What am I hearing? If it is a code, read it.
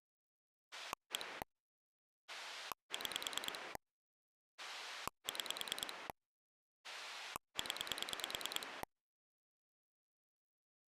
Pulse dialling, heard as a rotary dial, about 9 pulses a second. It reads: 1 6 6 0